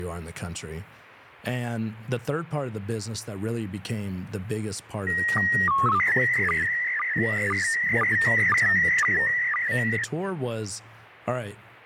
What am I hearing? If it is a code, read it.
SSTV (slow-scan television), PD 120, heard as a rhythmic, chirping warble, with radio static and speech in English.